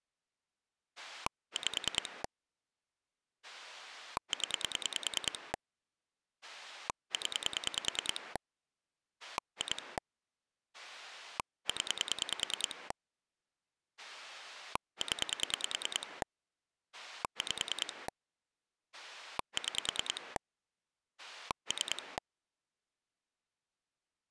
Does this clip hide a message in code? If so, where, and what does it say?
Yes: pulse dialling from 1.0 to 22.2 s, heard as a rotary dial, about 10 pulses a second. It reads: 5 0 0 2 0 0 5 6 3